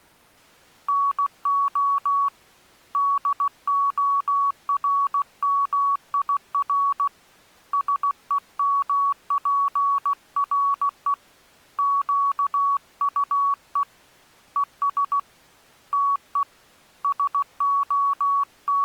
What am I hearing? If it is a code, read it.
Morse code, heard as a keyed tone, hand-sent with a paddle, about 16 wpm, 1120 Hz. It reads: NO DORMIR SEMPRE QUE ES TE …